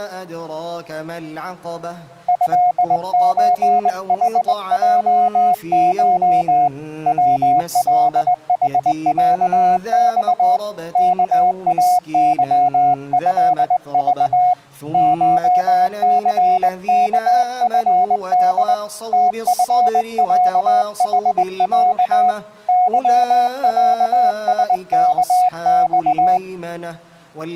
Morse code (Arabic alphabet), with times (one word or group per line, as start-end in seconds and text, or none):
2.3-6.7 هزحجش
7.1-10.6 ولحعص
11.0-14.5 كاظهض
14.9-18.7 شثكفد
19.1-22.3 تفعحع
22.7-26.4 ظعسكص